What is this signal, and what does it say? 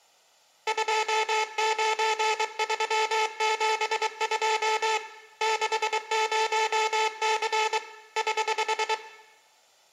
Morse code, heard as a buzzer, hand-sent with a paddle, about 23 wpm, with room echo. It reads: 29372 60C <HH>